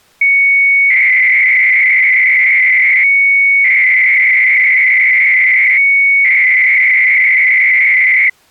300-baud modem data (Bell 103 tones), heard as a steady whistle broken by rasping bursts, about 300 baud, 200 Hz shift.